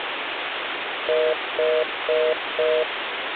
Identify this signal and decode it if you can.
Telephone call progress tone (North American plan), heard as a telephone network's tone, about 480, 620 Hz, 0.25 s on and 0.25 s off, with phone line noise. Congestion tone.